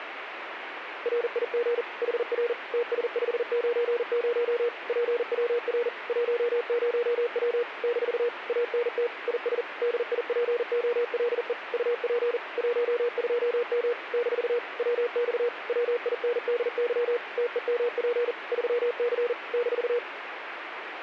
Morse code, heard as a keyed tone, machine-sent, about 40 wpm, 480 Hz, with radio static. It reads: RIG HR TS590 PWR 10W - ANT IS DIPOLE UP 12M - WX WINDY TEMP 3C -